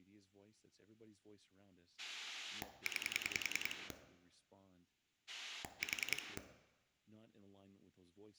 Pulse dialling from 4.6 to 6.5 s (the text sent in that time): 4